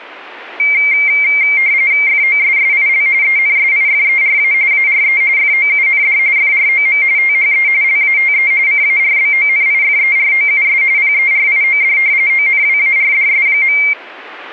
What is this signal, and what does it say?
RTTY (45.45 baud, 170 Hz shift), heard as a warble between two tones, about 2200 Hz centre. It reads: FOSSIL ENSIFERA ARE FOUND FROM THE LATE CARBONIFEROUS PERIOD ONWARDS.